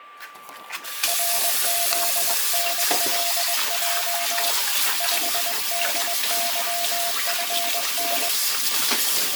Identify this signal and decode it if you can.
Morse code, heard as a keyed tone, hand-sent with a paddle, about 21 wpm, 690 Hz, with a steady whistle near 1170 Hz and kitchen noise. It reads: RZNLJ 5DYFN